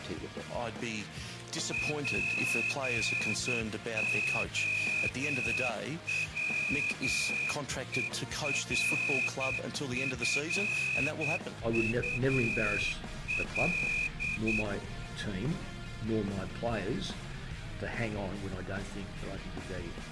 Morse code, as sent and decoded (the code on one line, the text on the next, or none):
.--. --- .-- . .-. ..-. ..- .-..
POWERFUL